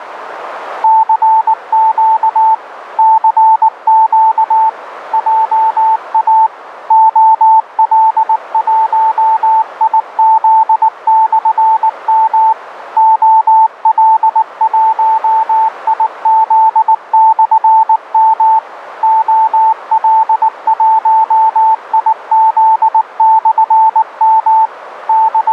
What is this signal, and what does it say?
Morse code, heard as a keyed tone, machine-sent, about 19 wpm, 880 Hz, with radio static. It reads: CQ CQ JA OL1IZ/M OL1IZ/M OL1IZ/M …